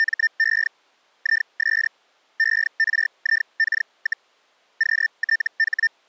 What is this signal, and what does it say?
Hellschreiber (Feld-Hell, 122.5 baud), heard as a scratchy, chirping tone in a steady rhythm, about 1800 Hz. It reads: … IS ERIK, QTH